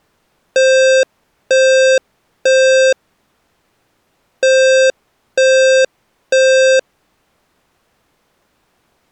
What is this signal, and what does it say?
Alarm pattern, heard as an alarm's beeps, played twice, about 520 Hz. Temporal three. Smoke or fire, evacuate.